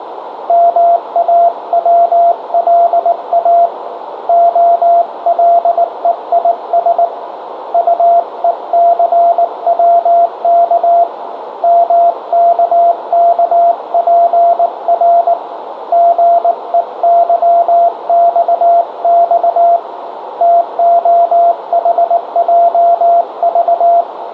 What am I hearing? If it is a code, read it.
Morse code, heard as a keyed tone, hand-sent with a paddle, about 19 wpm, 690 Hz, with radio static, a narrow filter and room echo. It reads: MAWLA OLEIS UECWK MKKPR GEYXX TOHJV